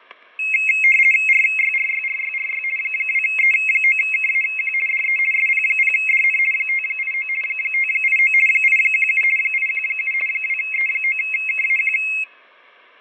RTTY (50 baud, 450 Hz shift), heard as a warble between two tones, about 2350 Hz centre, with fading and static crashes. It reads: RYRYRYRY 2E9KAQ DE SP0DN 589 589 817 817 2E9KAQ